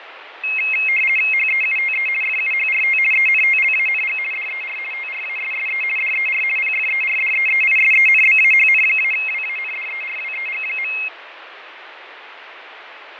RTTY (50 baud, 450 Hz shift), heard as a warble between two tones, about 2350 Hz centre, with radio static and fading. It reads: HEUTE FUHRT ENTLANG DER TRASSE DER PFERDEEISENBAHN-WANDERWEG.